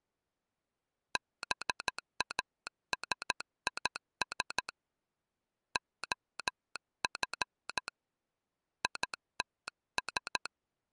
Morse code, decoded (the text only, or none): BASIS OF ITS